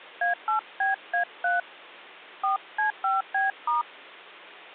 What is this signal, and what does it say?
DTMF, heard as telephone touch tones, dialled by hand, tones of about 130 ms. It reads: A8BA3 4C5B*